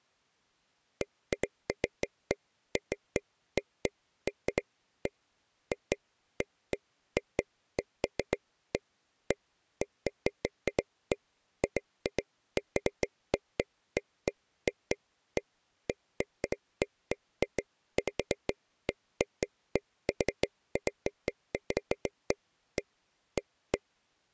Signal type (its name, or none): none